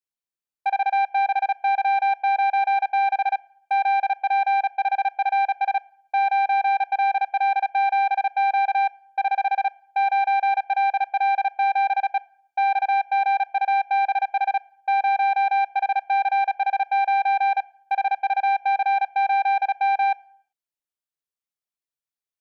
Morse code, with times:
0.7-3.4 46Y96
3.7-5.8 ZP5FS
6.1-8.9 9LL7Q
9.2-9.7 <HH>
10.0-12.2 9LL7E
12.6-14.6 XGUBH
14.9-17.6 0HCH9
17.9-20.1 HVC8M

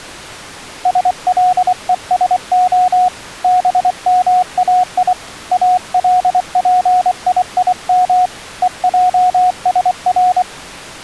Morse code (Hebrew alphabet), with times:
0.9-3.1 שלושה
3.4-5.1 במאי
5.5-8.3 אלפיים
8.6-10.4 ועשר

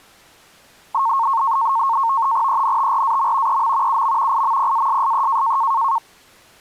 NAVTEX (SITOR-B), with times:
2.5-3.6 ENTRAM
3.5-4.0 EM
3.9-4.4 UM
4.3-5.6 IMPASSE

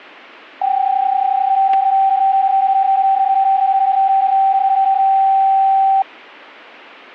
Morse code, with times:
none

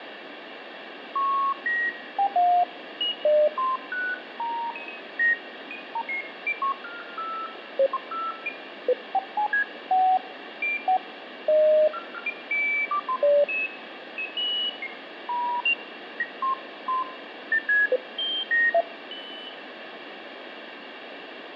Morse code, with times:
none

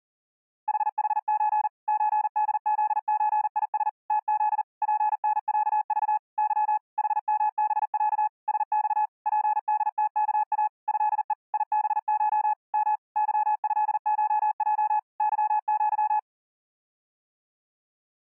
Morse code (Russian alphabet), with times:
0.7-1.7 ХХЧ
1.9-3.9 ЧДЗЧИС
4.1-4.6 ТЗ
4.8-6.2 ПНЯЖ
6.4-6.8 Ы
7.0-8.3 ХМБЯ
8.5-9.1 СЬ
9.3-10.7 ПДТКА
10.9-11.3 ЭЕ
11.5-12.5 ИБШ
12.7-13.0 М
13.2-15.0 ЫЭШЙ
15.2-16.2 ЫЪ

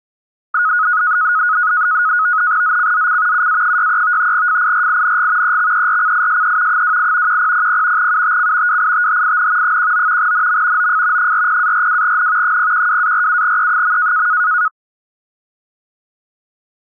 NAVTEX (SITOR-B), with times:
2.6-3.5 ZCZC
3.3-4.3 UA63
4.3-5.6 FIRING
5.4-6.8 EXERCISE
6.7-7.4 28
7.3-8.1 1000
8.0-8.8 UTC
8.7-9.8 WITHIN
9.6-10.3 19
10.2-10.9 NM
10.8-11.3 OF
11.2-12.6 40-42N
12.4-14.3 012-47E.

